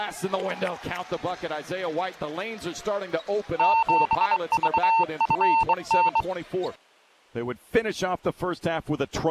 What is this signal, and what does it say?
Morse code, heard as a keyed tone, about 23 wpm, 900 Hz. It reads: 7VFN